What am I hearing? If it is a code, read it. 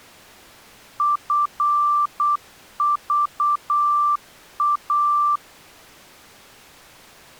Morse code, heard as a keyed tone, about 8 wpm, 1180 Hz. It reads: FVA